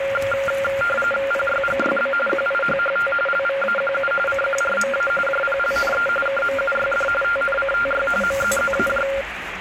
RTTY (45.45 baud, 850 Hz shift), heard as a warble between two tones, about 970 Hz centre, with radio static and the noise of a restaurant. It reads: PYGYB QIHHT LVAQU CQRMA JPLNE KMUYD TNCTY MZZAJ